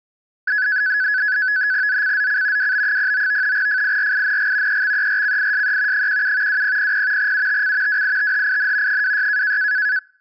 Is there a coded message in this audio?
Yes: NAVTEX (SITOR-B), 100 baud, 170 Hz shift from 0.5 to 10.0 s, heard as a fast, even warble, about 1600 Hz centre. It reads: ZCZC WB09 FIRING EXERCISE 17 2000 UTC WITHIN 26